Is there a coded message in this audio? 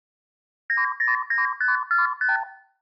Yes: multi-frequency trunk signalling (R2, with the far end's replies) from 0.7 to 2.4 s, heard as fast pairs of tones, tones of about 150 ms, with room echo. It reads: 909545